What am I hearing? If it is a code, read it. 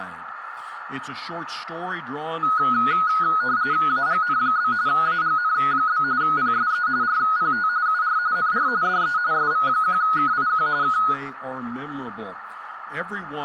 RTTY (45.45 baud, 170 Hz shift), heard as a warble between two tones, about 1360 Hz centre, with radio static and a narrow filter. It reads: AGN? AGN? PSE RPT UR NR DE SV1KIQ K